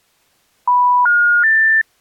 Telephone call progress tone (North American plan), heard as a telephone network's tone, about 980, 1430, 1800 Hz. Special information tone.